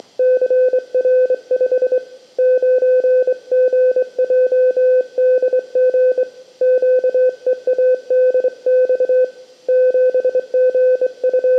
Morse code, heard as a keyed tone, hand-sent with a straight key, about 24 wpm, 510 Hz, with room echo. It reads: … 9GJDG QEADX …